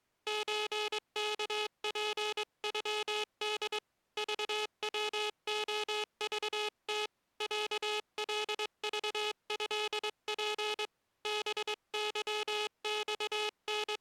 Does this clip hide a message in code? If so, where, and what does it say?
Yes: Morse code (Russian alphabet) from 0.2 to 14.0 s, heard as a buzzer, hand-sent with a straight key, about 22 wpm. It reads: ЧКПЮД ЖВОЖТ ЯЛЖЭП …